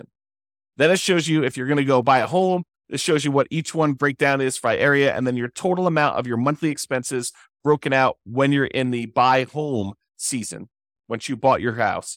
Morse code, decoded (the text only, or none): none